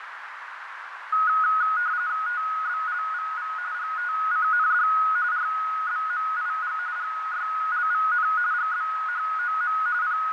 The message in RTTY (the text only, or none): TBLVV GTCND RBMIG GYLVN GBHOM …